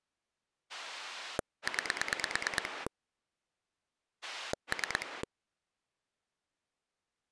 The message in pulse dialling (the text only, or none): 9 3